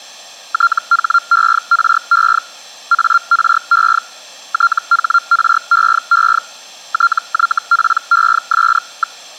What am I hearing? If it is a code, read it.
Hellschreiber (Feld-Hell, 122.5 baud), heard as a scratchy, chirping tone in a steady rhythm, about 1380 Hz. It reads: THERE ARE THREE TYPES.